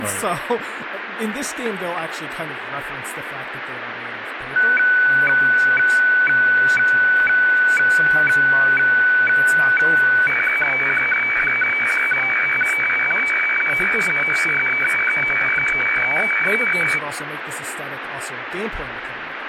Weather fax (radiofax), 120 lines a minute, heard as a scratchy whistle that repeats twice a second, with radio static and speech in English.